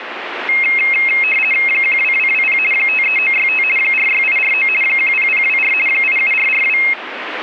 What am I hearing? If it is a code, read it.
RTTY (50 baud, 450 Hz shift), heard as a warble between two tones, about 2350 Hz centre, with radio static. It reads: 12220 53965 46849 10024 87442